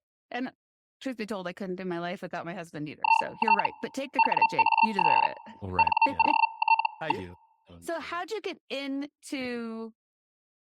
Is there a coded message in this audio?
Yes: Hellschreiber (Feld-Hell, 122.5 baud) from 3.0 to 7.3 s, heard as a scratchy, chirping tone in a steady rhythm, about 900 Hz, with speech in English. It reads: IT WAS NOT.